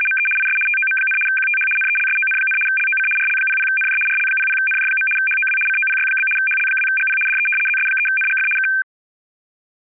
RTTY (75 baud, 850 Hz shift), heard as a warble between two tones, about 1950 Hz centre. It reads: … IS TOM, QTH NELSON, LOC RL00NJ RL00NJ. HOW COPY? HL2GP DE ZS3NGF K